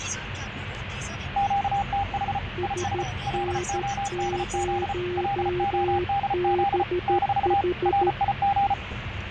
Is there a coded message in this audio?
Yes: Morse code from 1.3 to 8.8 s, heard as two keyed tones, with radio static, fading and the noise inside a car. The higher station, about 34 wpm, 800 Hz: QTH IS LODZ LODZ - RIG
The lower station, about 13 wpm, 360 Hz: SN0BH